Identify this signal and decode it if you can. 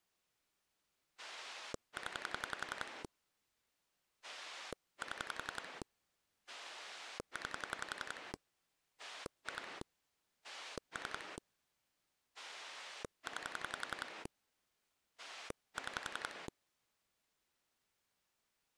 Pulse dialling, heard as a rotary dial, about 11 pulses a second. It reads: 0 7 9 2 3 9 6